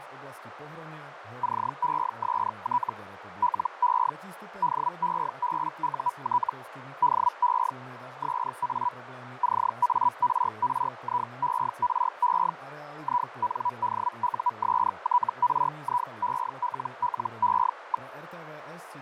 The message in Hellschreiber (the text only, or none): CEST LE DEBUT DE SA CARRIERE INDUSTRIELLE.